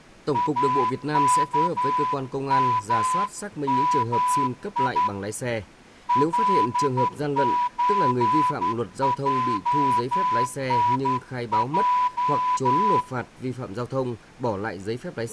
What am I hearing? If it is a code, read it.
Morse code (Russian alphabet), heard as a whistle, hand-sent with a straight key, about 11 wpm, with room echo and speech in Vietnamese. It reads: АКММИ ЛЧЙНЙ